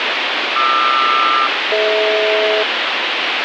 Aircraft SELCAL, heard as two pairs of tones, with heavy radio static. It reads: QR-DH